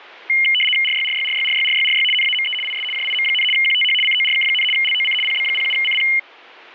RTTY (75 baud, 850 Hz shift), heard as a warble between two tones, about 2550 Hz centre. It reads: RYRYRYRYRYRY NAME IS JIM, QTH CORK, LOC PB07CP